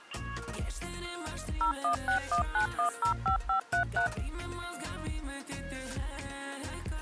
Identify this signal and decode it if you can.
DTMF, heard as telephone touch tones, dialled by machine, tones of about 100 ms. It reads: 01619105533